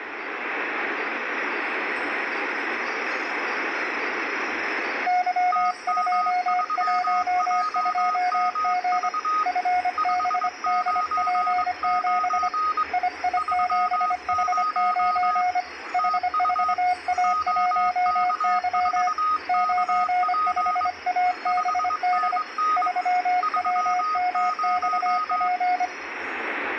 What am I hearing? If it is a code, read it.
Morse code, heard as two keyed tones, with radio static and room echo. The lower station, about 25 wpm, 720 Hz: Y212G FBDP7 II7H9 H4A1Y 95ABD 3WMXP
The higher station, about 22 wpm, 1250 Hz: TM3JMV 599 30 TU OK4KP 5NN 30